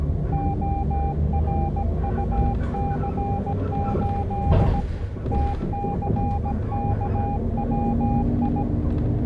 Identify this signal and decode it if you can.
Morse code, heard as a keyed tone, hand-sent with a paddle, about 17 wpm, 800 Hz, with the noise inside a bus. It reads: ORUC8 TCKWI